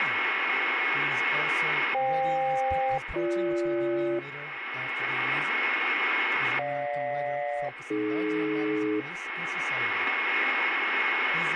Aircraft SELCAL, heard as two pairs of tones, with radio static and a steady whistle near 2180 Hz. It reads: FK-BG GJ-AD